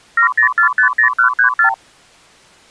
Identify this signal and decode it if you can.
Multi-frequency trunk signalling (R2, with the far end's replies), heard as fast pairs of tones, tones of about 100 ms. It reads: 70450134